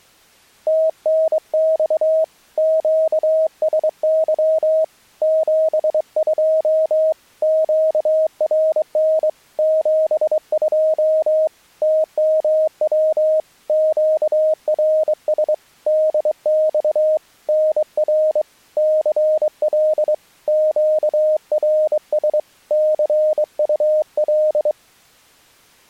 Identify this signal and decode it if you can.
Morse code, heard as a keyed tone, hand-sent with a straight key, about 23 wpm, 630 Hz. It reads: TNX QSY 72 QRN 72 TMW QRS DX NR CL QRS CUL